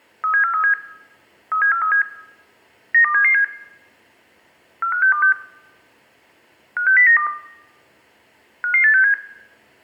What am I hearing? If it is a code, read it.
Five-tone selective call (CCIR), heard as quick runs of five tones, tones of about 100 ms, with room echo. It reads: 37437 37437 92777 45626 56092 55867